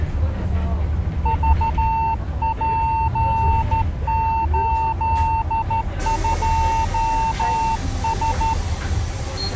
Morse code, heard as a keyed tone, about 13 wpm, 900 Hz, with the noise inside a bus. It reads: VP82S